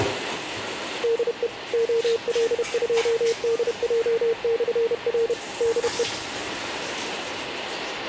Morse code, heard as a keyed tone, machine-sent, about 31 wpm, 460 Hz, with radio static and the noise of a restroom. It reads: DE OL2DJ/R DE